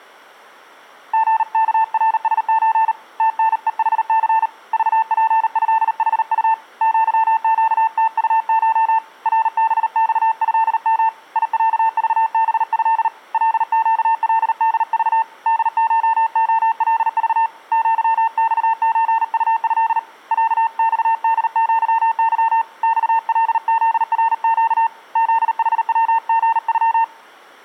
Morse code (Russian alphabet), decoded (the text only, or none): ГКРСЧ ТНЕХЦ ЖПЭХУ ЪЩТУШ РБЬЭМ ИЯЖБЭ ЛЩЛДЖ ДШОЛЖ ЪЬЧУЭ ЯЬДЪЫ ЬЛЗРЩ ЗХВГЮ